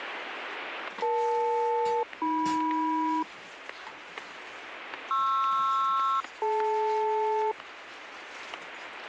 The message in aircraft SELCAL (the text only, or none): EL-AM PR-DL